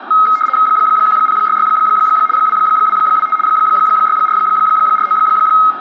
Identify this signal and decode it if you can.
RTTY (75 baud, 850 Hz shift), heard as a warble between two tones, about 1700 Hz centre, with radio static, room echo and speech in Manipuri. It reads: 1066 2225 6449